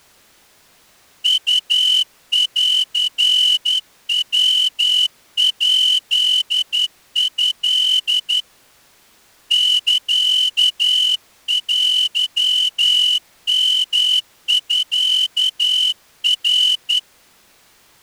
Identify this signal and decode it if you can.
Morse code (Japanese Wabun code), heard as a whistle, hand-sent with a straight key, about 11 wpm. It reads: ウンヤヱト サテヨミナ